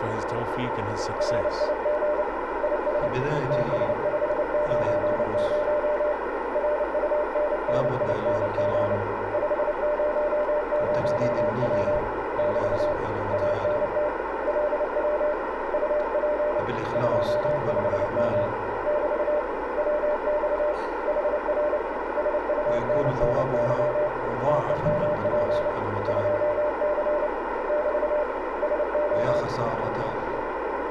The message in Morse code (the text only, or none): RIG IS TS590 RUNNING 500W <BT> ANT LW UP 25M <BT> WX HR SUNNY TEMP 2C <BT> SO